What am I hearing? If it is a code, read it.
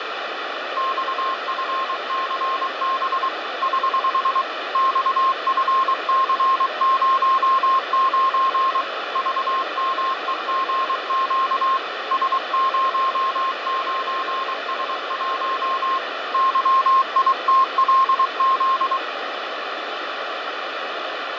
Morse code, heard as a keyed tone, hand-sent with a paddle, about 23 wpm, 1060 Hz, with radio static and fading. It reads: XFCB <HH> XFC09 VMEGQ S09S1 YITLZ